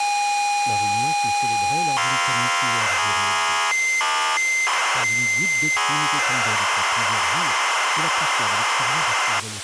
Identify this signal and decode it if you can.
ZX Spectrum tape loading, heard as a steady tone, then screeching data, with tape hiss and speech in French.